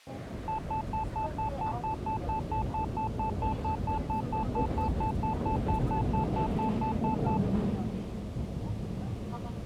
Evenly repeated beeps, with the noise inside a subway train. There is no code.